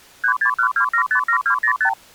Multi-frequency trunk signalling (R2, with the far end's replies), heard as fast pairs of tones, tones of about 90 ms. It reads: 3612757205